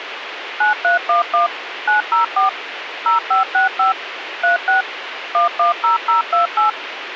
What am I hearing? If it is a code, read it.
DTMF, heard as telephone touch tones, dialled by machine, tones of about 130 ms, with radio hiss. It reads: 9311 904 0565 36 110028